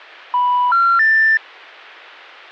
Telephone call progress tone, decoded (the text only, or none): special information tone